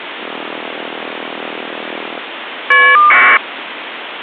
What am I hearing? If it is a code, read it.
Caller ID data burst, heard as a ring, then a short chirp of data, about 1200 baud, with phone line noise.